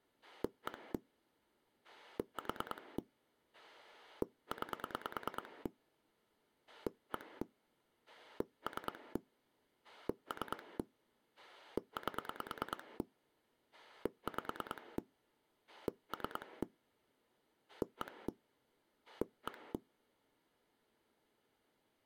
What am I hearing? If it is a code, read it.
Pulse dialling, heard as a rotary dial, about 9 pulses a second. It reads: 1 4 9 1 3 3 8 5 3 1 1